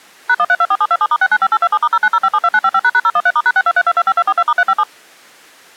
DTMF, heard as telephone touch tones, dialled by machine, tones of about 50 ms. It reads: #1324727*695827*090572955##013*#623225242*357